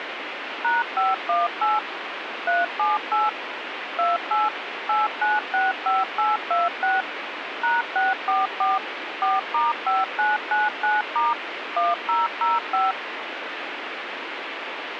DTMF, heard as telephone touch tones, dialled by machine, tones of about 180 ms, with radio hiss. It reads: #518 378 28 8965826 #644 4*5999* 1005